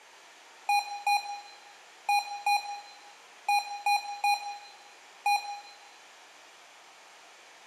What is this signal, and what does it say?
Beep code, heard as beeps from a small speaker, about 820 Hz, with room echo. 2-2-3-1. In Phoenix BIOS tables: unexpected interrupt.